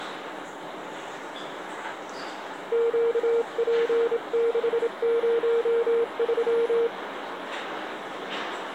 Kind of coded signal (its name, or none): Morse code